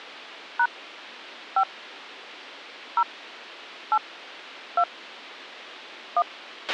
DTMF, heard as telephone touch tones, dialled by hand, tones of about 70 ms, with a squelch burst at the end. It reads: # 5 0 8 2 1